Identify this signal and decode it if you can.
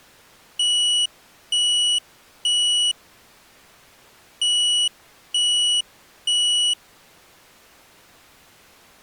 Alarm pattern, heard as an alarm's beeps, played twice, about 2950 Hz. Temporal three. Smoke or fire, evacuate.